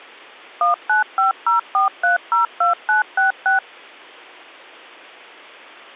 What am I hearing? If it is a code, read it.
DTMF, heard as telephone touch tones, dialled by machine, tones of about 130 ms. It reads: 19504302966